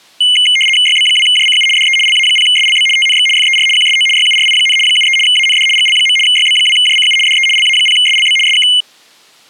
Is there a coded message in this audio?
Yes: RTTY (75 baud, 850 Hz shift) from 0.2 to 8.8 s, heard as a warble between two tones, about 2550 Hz centre. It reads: YB2JCU DE LA0SLB TNX FER QSO YURI, 73 AND GL. YB2JCU DE LA0SLB SK